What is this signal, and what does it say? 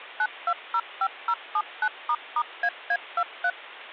DTMF, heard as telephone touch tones, dialled by machine, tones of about 60 ms. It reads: 9205079**AA23